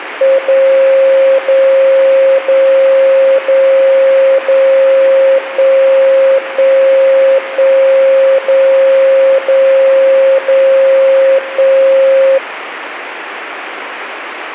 Radio time signal (DCF77), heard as a tone whose level steps once a second, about 540 Hz, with radio static. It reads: 0 0 0 0 0 1 1 1 0 0 0 1